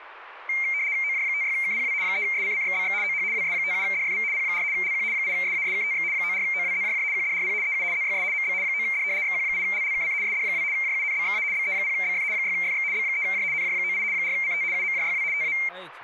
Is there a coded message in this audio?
Yes: RTTY (75 baud, 170 Hz shift) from 0.5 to 15.7 s, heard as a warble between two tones, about 2200 Hz centre, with speech in Maithili. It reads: OJ56KPW 3SCCXBX OH WS57DFV P4 LQ 8SASKTX 94OWZJJ QDRP EU ZYS MB 9D XQ8LLKC SD2 JUNBXA BE0BF 6FX B3J NJ98 4CT UMJYW TA